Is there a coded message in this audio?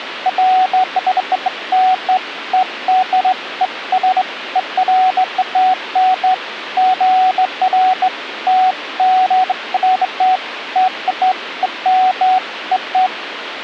No, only beeps of irregular length, with phone line noise.